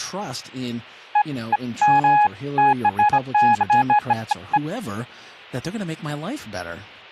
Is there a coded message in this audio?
No, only beeps of irregular length, with speech in English.